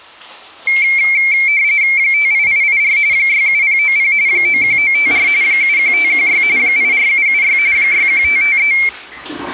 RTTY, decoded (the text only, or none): 58884 67090 91954 71516 84776 61553